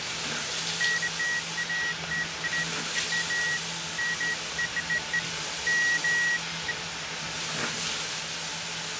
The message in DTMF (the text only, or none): none